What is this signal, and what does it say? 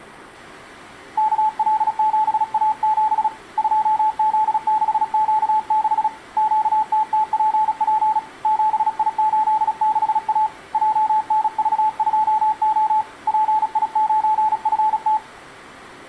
Morse code, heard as a keyed tone, hand-sent with a paddle, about 36 wpm, 860 Hz. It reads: KL7A7 2Z6Q6 QTTPP 7I86A JNV2O PI9FT